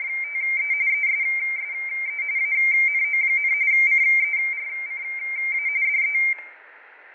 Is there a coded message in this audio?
Yes: RTTY (45.45 baud, 170 Hz shift) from 0.0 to 6.3 s, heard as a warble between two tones, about 2200 Hz centre, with radio static, fading, static crashes and room echo. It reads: … ESSE ANO, CERCA DE